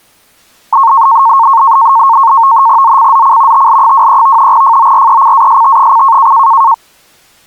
NAVTEX (SITOR-B), 100 baud, 170 Hz shift, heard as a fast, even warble, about 1000 Hz centre. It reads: ZCZC TL23 FORECAST: